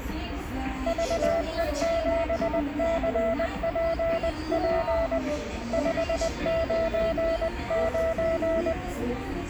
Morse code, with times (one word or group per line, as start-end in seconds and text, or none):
0.9-5.2 VE7CPP
5.7-8.7 599